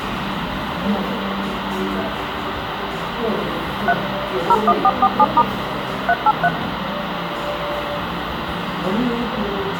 DTMF, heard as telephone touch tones, dialled by machine, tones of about 50 ms, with radio hiss and the noise of a crowd indoors. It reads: 3 01447* 383